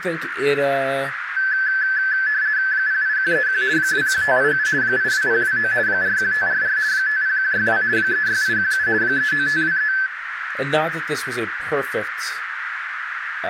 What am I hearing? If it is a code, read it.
RTTY (50 baud, 170 Hz shift), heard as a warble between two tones, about 1650 Hz centre, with radio static, a narrow filter and speech in English. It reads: 08131 21587 82029 41544 50162 36817 39523